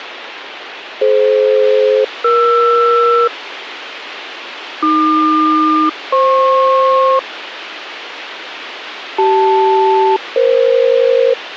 Aircraft SELCAL, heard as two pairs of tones, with radio hiss. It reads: DF-ER AQ-FP CL-EF